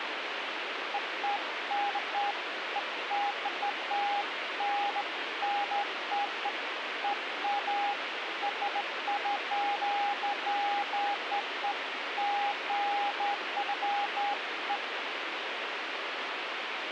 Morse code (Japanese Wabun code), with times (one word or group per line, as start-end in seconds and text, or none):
none